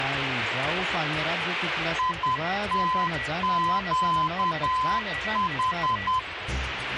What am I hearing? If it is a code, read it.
Morse code, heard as a keyed tone, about 10 wpm, 1020 Hz, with radio static and a weaker station near 1950 Hz. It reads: ITQH